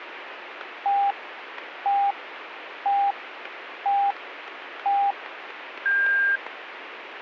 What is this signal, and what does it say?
Radio time signal (five pips and a higher one, as on Chinese radio), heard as pips, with radio static.